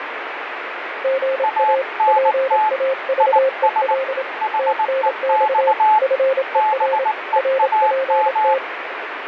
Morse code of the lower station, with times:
1.0-1.8 GA
2.1-4.2 PAVEL
4.6-5.7 TNX
6.0-7.0 FER
7.4-8.6 RPT

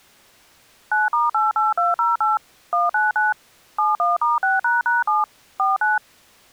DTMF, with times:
0.9-2.4 9*88208
2.7-3.3 199
3.8-5.2 71*6##7
5.6-6.0 49

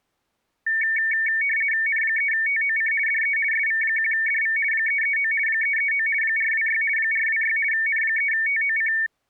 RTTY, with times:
1.9-2.9 N3TOC
3.1-3.4 DE
3.5-4.6 SV1DV
4.7-5.3 339
5.5-6.1 339
6.2-6.8 426
7.0-7.6 426
7.7-8.9 N3TOC

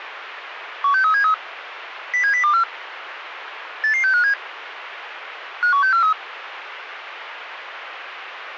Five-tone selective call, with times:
0.8-1.3 16373
2.1-2.6 07024
3.8-4.3 88657
5.6-6.1 51643

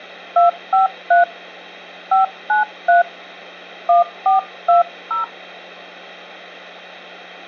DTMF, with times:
0.4-1.2 253
2.1-3.0 593
3.9-5.2 1420

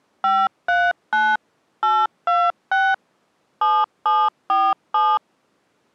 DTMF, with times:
0.2-1.4 539
1.8-2.9 826
3.6-5.2 7747

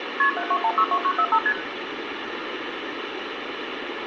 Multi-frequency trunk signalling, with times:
0.2-0.3 KP
0.4-1.4 72162945
1.5-1.5 ST

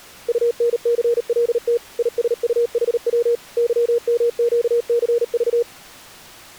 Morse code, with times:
0.3-1.8 UNCLT
2.0-3.4 ISUHW
3.6-5.6 YMQCV

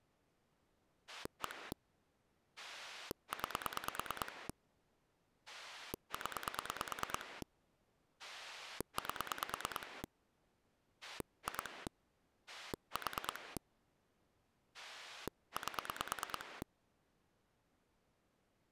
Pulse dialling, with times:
1.1-1.7 1
2.6-4.5 9
5.5-7.4 0
8.2-10.0 8
11.0-11.9 2
12.5-13.6 4
14.7-16.6 8

